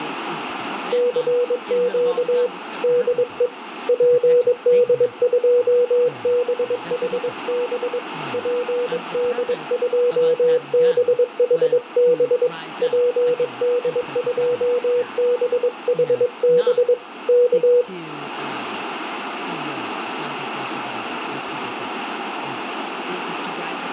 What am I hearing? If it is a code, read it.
Morse code, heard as a keyed tone, hand-sent with a paddle, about 22 wpm, 490 Hz, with radio static, room echo and speech in English. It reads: CQ DE PD2BHB PD2BHB PD2BHB K